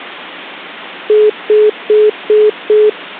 Telephone call progress tone (single-tone plan, as in most of Europe), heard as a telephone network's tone, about 420 Hz, 0.2 s on and 0.2 s off. Congestion tone.